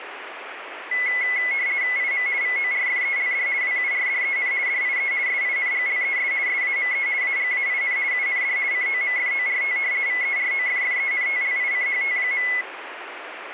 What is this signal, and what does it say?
RTTY (50 baud, 170 Hz shift), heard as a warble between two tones, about 2100 Hz centre, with radio static. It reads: IM VORFELD WURDEN DIE SINGLES SAME AGAIN UND COMFORT VEROFFENTLICHT.